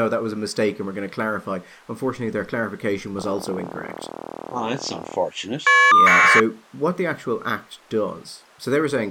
Caller ID data burst, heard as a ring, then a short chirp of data, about 1200 baud, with speech in English.